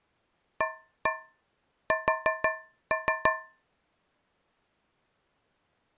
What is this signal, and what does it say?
Tap code, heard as taps on a metal pipe, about 5 knocks a second. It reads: AS